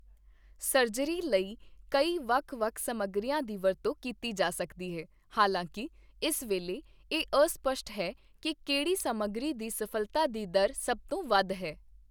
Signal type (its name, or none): none